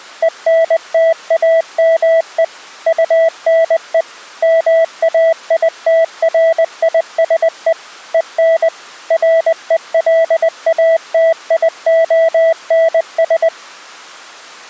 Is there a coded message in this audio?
Yes: Morse code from 0.2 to 13.5 s, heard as a keyed tone, machine-sent, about 20 wpm, 660 Hz. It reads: ENTAME UNE MAITRISE EN RELATIONS